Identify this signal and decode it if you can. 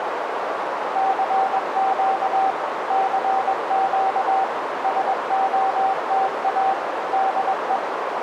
Morse code, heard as a keyed tone, machine-sent, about 21 wpm, 770 Hz, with heavy radio static and a narrow filter. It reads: CQ CQ SOTA DE